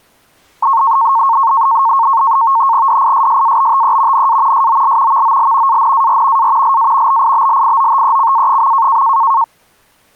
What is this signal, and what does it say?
NAVTEX (SITOR-B), 100 baud, 170 Hz shift, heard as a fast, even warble, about 1000 Hz centre. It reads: DISSABTE NA SOL VOL ANAR A LA BIBLIOTECA.